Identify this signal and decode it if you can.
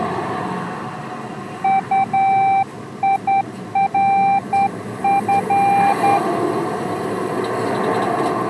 Morse code, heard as a keyed tone, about 10 wpm, 790 Hz, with street noise. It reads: UIRF